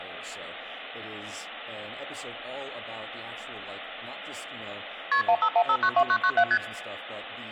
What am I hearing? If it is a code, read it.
Multi-frequency trunk signalling (R1, as on North American trunks), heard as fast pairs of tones, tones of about 70 ms, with speech in English. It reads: KP 151592997 ST